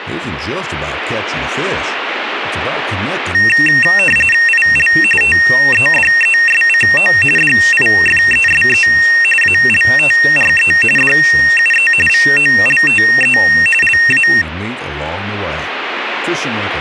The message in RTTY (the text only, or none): IL TEDESCO DIFESE ALTRE DUE VOLTE LA